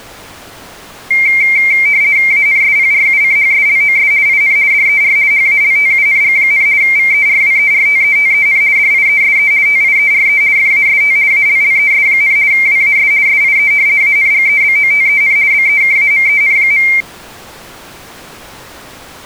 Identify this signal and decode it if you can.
RTTY (50 baud, 170 Hz shift), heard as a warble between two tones, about 2200 Hz centre. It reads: ANSPRUCHSLOS IN DER HALTUNG, VERWERTETEN DIESE TIERE FAST ALLES, WAS SIE ANGEBOTEN BEKAMEN.